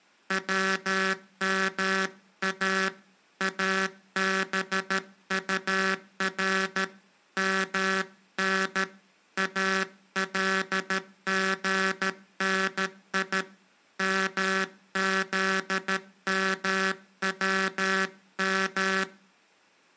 Morse code (Arabic alphabet), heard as a buzzer, hand-sent with a paddle, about 13 wpm. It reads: وما ابطر من الغني مذموم